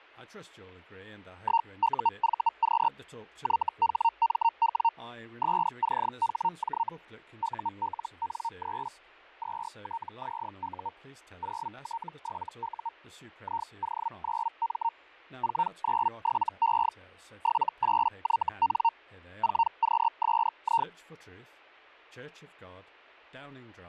Hellschreiber (Feld-Hell, 122.5 baud), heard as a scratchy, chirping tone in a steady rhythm, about 920 Hz, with fading and speech in English. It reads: 1UVQ YHMW SCHJ ULN3 2TZU 0T7U IO9M 497E 78YN 4QSI